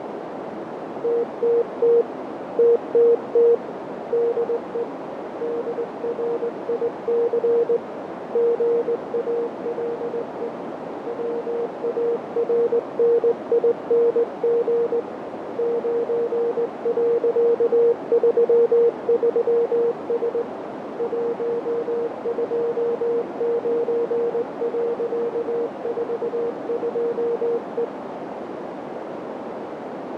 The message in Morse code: TTT TTT DE DRIC GALE WARNING 9.33S 129.42E

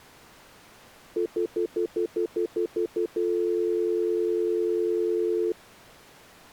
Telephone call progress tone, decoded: stutter dial tone

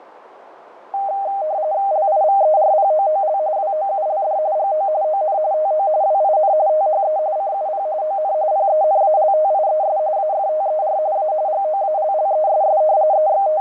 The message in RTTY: LIVERPOOL WOULD GO ON TO WIN THE CUP ON PENALTIES AFTER A GOALLESS …

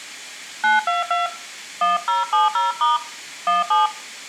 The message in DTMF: 922 1070* 17

